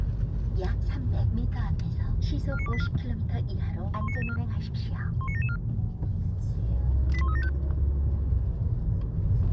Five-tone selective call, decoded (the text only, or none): 49284 19774 19774 81375